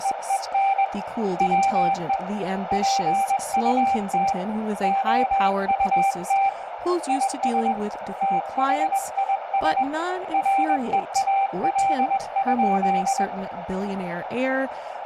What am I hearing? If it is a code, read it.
Morse code, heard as a keyed tone, hand-sent with a paddle, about 21 wpm, 780 Hz, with radio static, a narrow filter and speech in English. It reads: … WE PUT OUT IS THIS REAL?